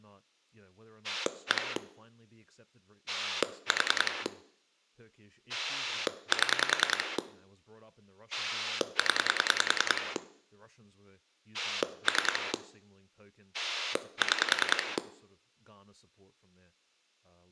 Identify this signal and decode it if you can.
Pulse dialling, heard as a rotary dial, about 10 pulses a second, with room echo and speech in English. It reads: 1 4 7 0 3 6